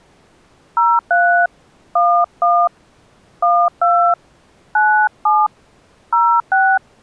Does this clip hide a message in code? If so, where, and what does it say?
Yes: DTMF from 0.8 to 6.8 s, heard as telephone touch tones, dialled by hand, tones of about 270 ms. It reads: 03 11 12 97 06